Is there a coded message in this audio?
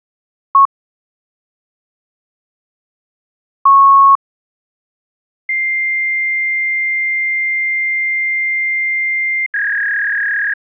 Yes: fax machine handshake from 0.5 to 10.5 s, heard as a beep, a long tone and a warble.